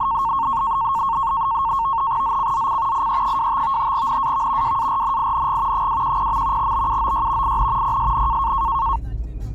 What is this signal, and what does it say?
NAVTEX (SITOR-B), 100 baud, 170 Hz shift, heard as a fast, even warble, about 1000 Hz centre, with the noise inside a car. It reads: ZCZC IE25 NAV WARNING 210. BUOY IN PSN